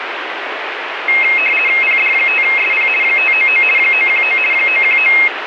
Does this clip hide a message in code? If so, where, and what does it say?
Yes: RTTY (50 baud, 450 Hz shift) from 1.1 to 5.3 s, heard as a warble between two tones, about 2350 Hz centre, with radio static. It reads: PD5SP 599 919 919